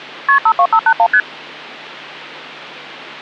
Multi-frequency trunk signalling (R1, as on North American trunks), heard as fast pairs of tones, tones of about 70 ms. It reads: KP 52581 ST